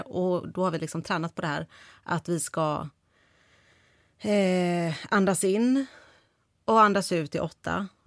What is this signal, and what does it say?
Speech in Swedish. There is no code.